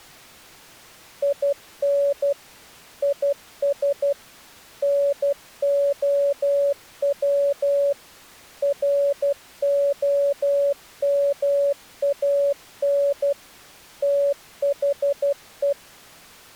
Morse code, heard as a keyed tone, machine-sent, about 12 wpm, 560 Hz. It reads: IN IS NOW ROMAN THE